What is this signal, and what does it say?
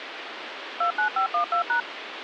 DTMF, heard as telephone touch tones, dialled by machine, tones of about 100 ms, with phone line noise. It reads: 29512#